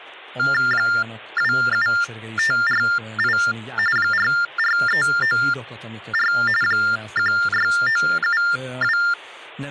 TTY/TDD text telephone tones (45.45 baud Baudot), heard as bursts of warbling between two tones, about 400 Hz shift, 1600 Hz centre, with speech in Hungarian. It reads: 27548 44394 16972